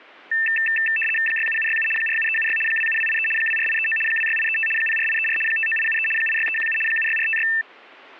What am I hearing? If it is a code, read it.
RTTY (75 baud, 850 Hz shift), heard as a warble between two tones, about 2200 Hz centre, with static crashes. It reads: 67767 47376 27283 24839 26835 04834 59873 86317 76456